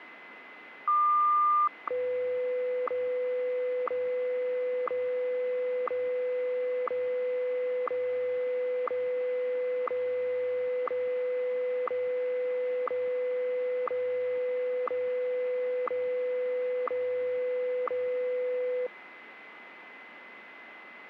Radio time signal (WWVH, Hawaii), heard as ticks, one a second, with radio static and a steady whistle near 2040 Hz.